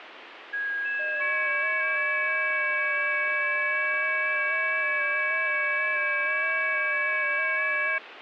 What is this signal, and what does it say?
FT8 (several signals at once), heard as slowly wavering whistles, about 6.25 baud, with radio static.